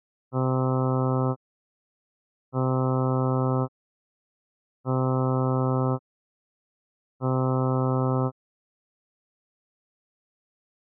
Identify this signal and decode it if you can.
Ship horn signal, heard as a ship's horn, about 130 Hz. 4 short. At sea: a pilot vessel's identity signal in fog.